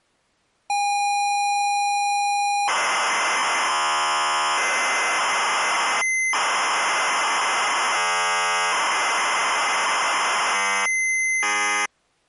ZX Spectrum tape loading, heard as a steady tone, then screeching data.